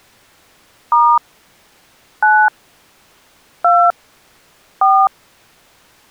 DTMF, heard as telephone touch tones, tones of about 260 ms. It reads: * 9 2 4